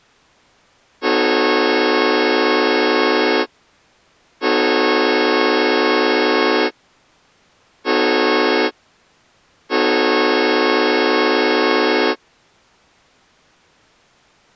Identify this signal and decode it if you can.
Train horn signal, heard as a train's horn. 2 long, 1 short, 1 long. On North American railways: approaching a public crossing.